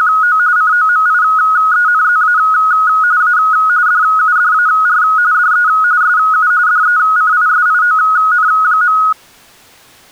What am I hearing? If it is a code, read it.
RTTY (45.45 baud, 170 Hz shift), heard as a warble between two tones, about 1360 Hz centre. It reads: … COMIENZA A DUDAR DE SU DECISION.